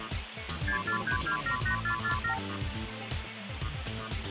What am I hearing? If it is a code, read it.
Multi-frequency trunk signalling (R2, with the far end's replies), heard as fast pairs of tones, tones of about 100 ms, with phone line noise. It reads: 643278447